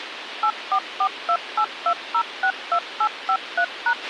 DTMF, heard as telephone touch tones, dialled by machine, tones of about 70 ms, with radio hiss and a squelch burst at the end. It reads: 844282062853#